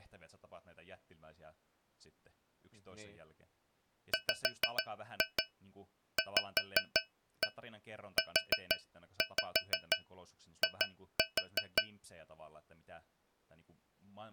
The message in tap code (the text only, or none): WVUI